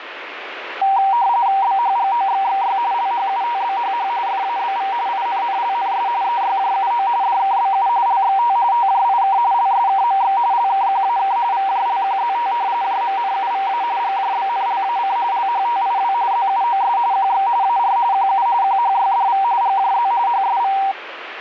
RTTY (45.45 baud, 170 Hz shift), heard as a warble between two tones, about 860 Hz centre, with radio static. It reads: BHGOXXY LHUTBHH FABV INNLNS EYJUO DKBU LXT TJIK LSKMX LKQAK VJLQZT JMNUVA GJBNLAC LHTIW ZUOS QX AR QU QHYDV GJZ HSV